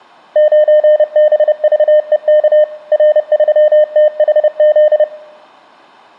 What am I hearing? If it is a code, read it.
Morse code, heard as a keyed tone, machine-sent, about 30 wpm, 610 Hz. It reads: 9BVEK R3THZ